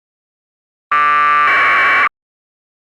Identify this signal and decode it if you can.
Packet radio (AX.25, as in APRS), 1200 baud, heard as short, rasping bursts.